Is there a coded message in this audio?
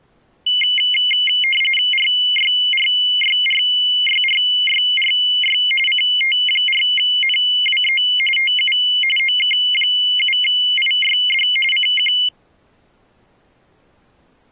Yes: RTTY (45.45 baud, 850 Hz shift) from 0.5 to 12.3 s, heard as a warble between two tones, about 2550 Hz centre. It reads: RYRYRYRYRY CT4NWE TU OK7IYD CQ